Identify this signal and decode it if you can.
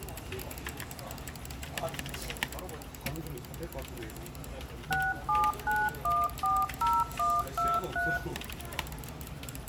DTMF, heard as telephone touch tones, dialled by machine, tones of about 220 ms, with the noise of a crowd indoors. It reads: 679140123